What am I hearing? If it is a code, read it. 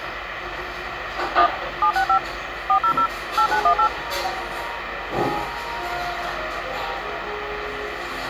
DTMF, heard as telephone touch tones, dialled by machine, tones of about 90 ms, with phone line noise and the noise of a cafe. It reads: 1 765 400 8918